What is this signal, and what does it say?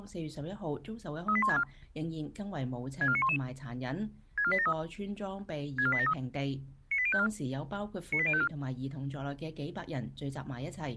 Five-tone selective call (ZVEI), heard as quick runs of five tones, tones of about 70 ms. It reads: 38164 64911 64873 64873 98054 98054